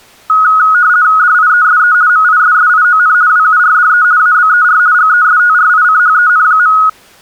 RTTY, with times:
1.2-1.9 DIESE
2.1-3.1 MISSION
3.3-4.0 WURDE
4.2-4.8 ABER
4.9-6.7 GESTRICHEN.

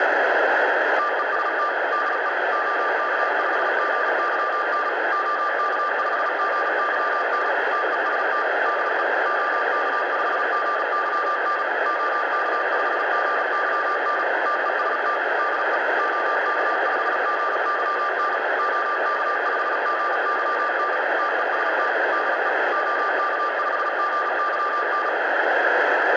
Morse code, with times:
1.0-1.7 TEST
1.9-2.3 DE
2.5-4.9 OK5GYN
5.1-7.5 OK5GYN
7.7-8.4 TEST
8.7-9.0 DE
9.3-11.6 OK5GYN
11.9-14.2 OK5GYN
14.5-15.2 TEST
15.4-15.8 DE
16.0-18.4 OK5GYN
18.6-21.0 OK5GYN
21.2-21.9 TEST
22.1-22.5 DE
22.7-25.1 OK5GYN

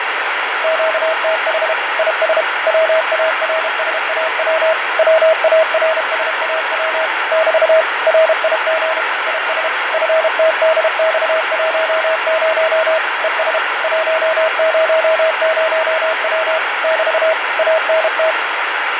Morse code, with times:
0.6-1.7 QTH
2.0-2.4 IS
2.7-4.7 WARSAW
5.0-7.1 WARSAW
7.3-7.8 <BT>
8.1-9.0 RIG
9.3-9.7 IS
9.9-13.0 FTDX10
13.2-13.6 ES
13.8-16.6 100W
16.8-17.3 <BT>
17.6-18.3 ANT

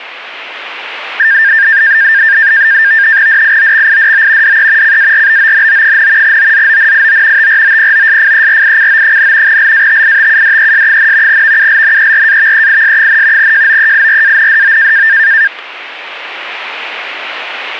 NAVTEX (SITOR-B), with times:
3.3-4.6 DIOXIDO
4.4-5.0 DE
4.8-6.4 CARBONO,
6.2-7.5 OZONIO
7.4-9.6 TROPOSFERICO,
9.5-11.4 LATITUDES,
11.3-13.5 VULNERAVEIS,
13.4-15.1 JOEIRANDO

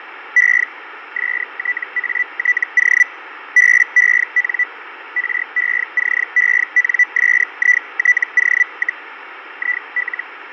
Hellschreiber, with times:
0.4-0.6 E
1.2-3.0 STATO
3.6-4.6 BEN
5.2-9.0 RECENSITO,
9.6-10.2 IL

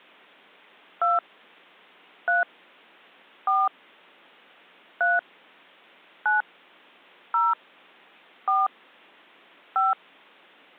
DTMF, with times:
1.0-1.2 2
2.3-2.4 3
3.5-3.7 4
5.0-5.2 3
6.3-6.4 9
7.3-7.5 0
8.5-8.7 4
9.8-9.9 5

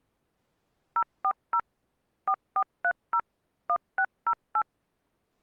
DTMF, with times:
1.0-1.6 040
2.3-3.2 4430
3.7-4.6 1608

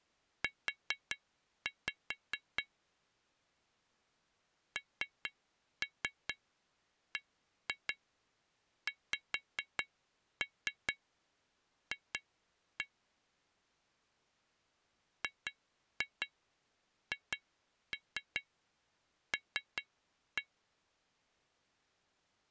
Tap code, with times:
0.4-2.6 U
4.8-12.8 NBXF
15.2-20.4 GHL

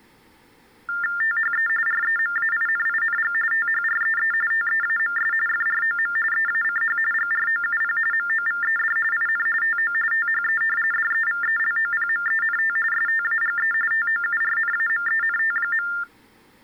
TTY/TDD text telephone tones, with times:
1.2-1.7 THE
1.9-3.3 REMAINING
3.5-4.3 THREE
4.5-5.3 TEAMS
5.5-6.2 FROM
6.3-7.0 EACH
7.1-8.0 GROUP
8.1-9.0 MOVED
9.1-9.5 IN
9.6-9.9 TO
10.1-10.6 THE
10.9-12.8 DEVELOPMENT
12.9-13.7 STAGE
13.9-15.9 TOURNAMENT.

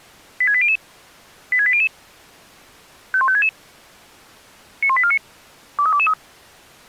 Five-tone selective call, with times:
0.4-0.8 86800
1.5-1.9 86800
3.1-3.5 51566
4.8-5.2 91849
5.8-6.1 23223

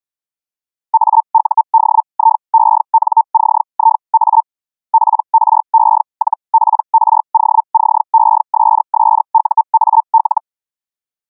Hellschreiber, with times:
0.9-4.4 AUDIENCIA
4.9-10.4 PRE-PROCESSUAL

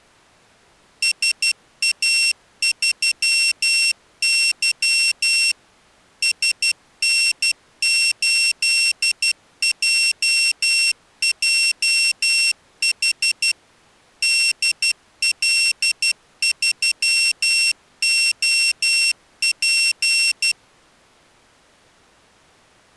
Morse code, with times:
1.0-5.5 SA3Y
6.2-13.5 SN8JJH
14.2-20.5 DL3OP

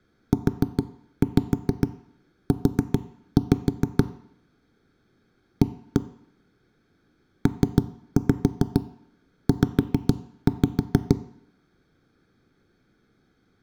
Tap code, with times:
0.3-4.0 UU
5.6-6.0 A
7.5-11.2 PZ

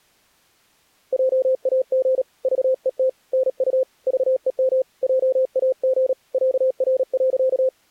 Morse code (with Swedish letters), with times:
1.1-2.2 JAG
2.4-3.1 VET
3.3-3.8 NU
4.1-4.8 VEM
5.0-6.1 JAG
6.3-7.7 ÄR.

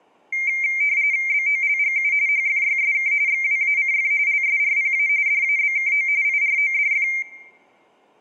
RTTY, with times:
1.3-2.1 BOLGU
2.3-3.1 HFYSK
3.3-4.1 XWACF
4.3-5.1 LSRPA
5.3-6.1 DABKO
6.2-7.1 IRODF

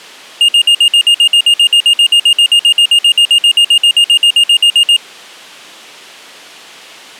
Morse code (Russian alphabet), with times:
none

